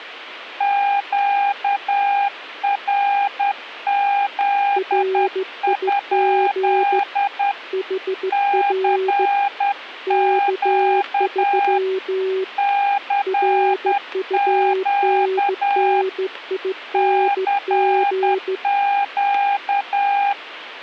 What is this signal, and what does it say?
Morse code, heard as two keyed tones. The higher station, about 10 wpm, 800 Hz: QRZ? CQ CQ CQ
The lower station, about 15 wpm, 380 Hz: RIG HR K3 RUNNING